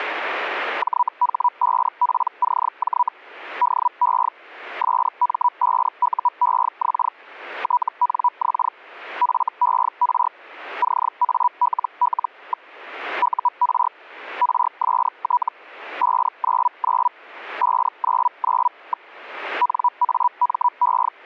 Hellschreiber (Feld-Hell, 122.5 baud), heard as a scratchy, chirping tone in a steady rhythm, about 980 Hz. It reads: JH5PCJ DE SM5UEX TNX FER CALL. UR RST 599 599. NAME